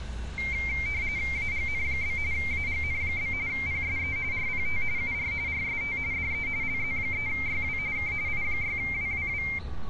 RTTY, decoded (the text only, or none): AGN? AGN? PSE RPT UR RST DE LZ3YW K I6WWW